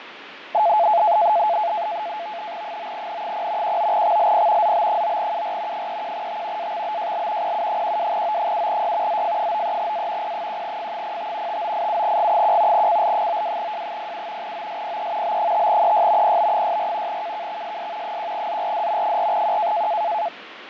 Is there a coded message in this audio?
Yes: NAVTEX (SITOR-B), 100 baud, 170 Hz shift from 0.5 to 20.3 s, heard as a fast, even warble, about 770 Hz centre, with radio static and fading. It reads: 9N0 19XLP ZB9UR 31T AXBJL PU12O7Y ZF93A P1F05 5987G1 CL92J07 OSPE B5EY PB64 KKXSS 1ZRD 4Q